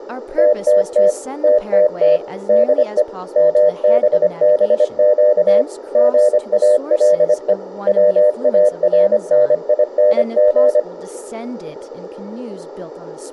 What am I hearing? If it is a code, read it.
Morse code, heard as a keyed tone, machine-sent, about 25 wpm, 600 Hz, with radio static, room echo and speech in English. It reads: TTT TTT DE MBBQ GALE WARNING